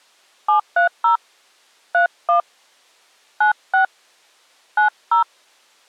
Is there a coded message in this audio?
Yes: DTMF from 0.5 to 5.2 s, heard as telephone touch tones, dialled by hand, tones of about 110 ms. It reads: 730 31 96 90